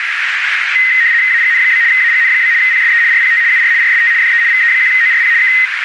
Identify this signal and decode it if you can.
RTTY (75 baud, 170 Hz shift), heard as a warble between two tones, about 1950 Hz centre, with radio static and a narrow filter. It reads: AGN? AGN? PSE RPT UR RST DE VE1ORP K